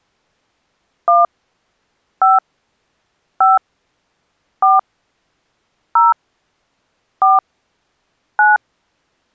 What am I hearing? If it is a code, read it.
DTMF, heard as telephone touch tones, dialled by hand, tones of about 170 ms. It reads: 1 5 5 4 0 4 9